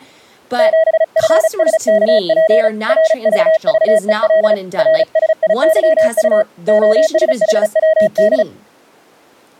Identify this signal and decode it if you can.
Morse code, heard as a keyed tone, hand-sent with a paddle, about 35 wpm, 640 Hz, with speech in English. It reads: 7FSKP RVVEL RSIYU OSHWD